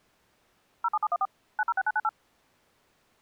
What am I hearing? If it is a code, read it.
DTMF, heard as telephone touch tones, dialled by machine, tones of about 40 ms. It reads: 07714 906998